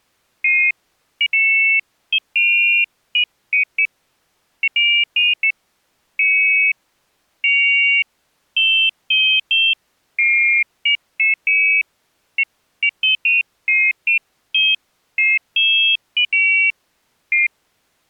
Pairs of high tones at irregular times. There is no code.